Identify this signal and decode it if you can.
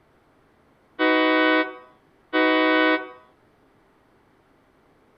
Train horn signal, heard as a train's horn, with room echo. 2 short. On North American railways: a signal is acknowledged.